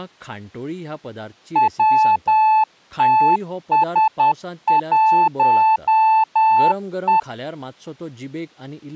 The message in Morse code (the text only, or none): WTS1E